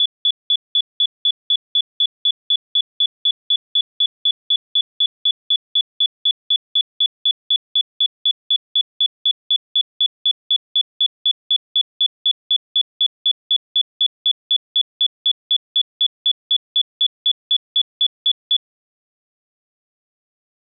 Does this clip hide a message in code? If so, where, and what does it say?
No, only evenly repeated beeps.